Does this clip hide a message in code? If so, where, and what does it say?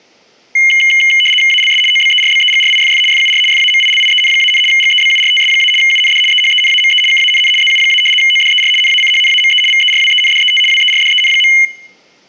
Yes: RTTY (75 baud, 850 Hz shift) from 0.6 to 11.7 s, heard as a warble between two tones, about 2550 Hz centre. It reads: ALS OBERBEGRIFF FUR FAMILIEN-, GEBURTS- UND EHENAME KANN ZU- ODER NACHNAME VERWENDET WERDEN.